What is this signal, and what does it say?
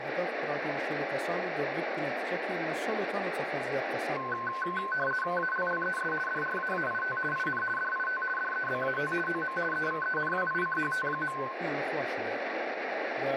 RTTY (50 baud, 450 Hz shift), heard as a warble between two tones, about 1280 Hz centre, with radio static and room echo. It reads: ALLES DRAAIT IN DIT DEBAT OM EVENWICHT.